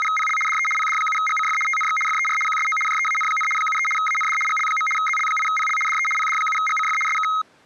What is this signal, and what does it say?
RTTY (75 baud, 850 Hz shift), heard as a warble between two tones, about 1700 Hz centre. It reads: … DE PD7GCF TNX FER QSO JEAN, 73 AND GL. ZL8PL DE PD7GCF SK